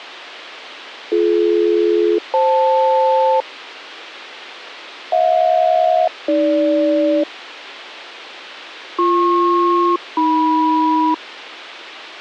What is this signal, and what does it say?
Aircraft SELCAL, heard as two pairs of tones. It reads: BD-FL HJ-AG BP-AM